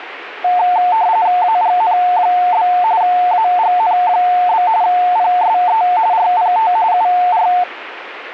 RTTY (45.45 baud, 170 Hz shift), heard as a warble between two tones, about 800 Hz centre, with radio static. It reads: AGN? AGN? PSE RPT UR